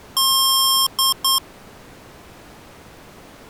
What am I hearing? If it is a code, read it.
Beep code, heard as beeps from a small speaker, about 1070 Hz. 1 long, 2 short. In Award, IBM and AMI BIOS tables: video adapter failure.